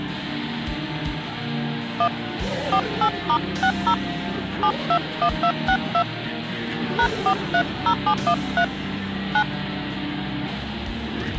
DTMF, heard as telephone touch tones, dialled by hand, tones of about 80 ms. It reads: 1 48*60 721262 #430713 9